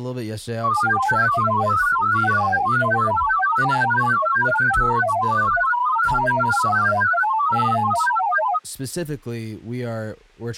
Multi-tone FSK (Olivia or MFSK type), about 1000 Hz wide, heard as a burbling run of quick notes, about 31.25 baud, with speech in English.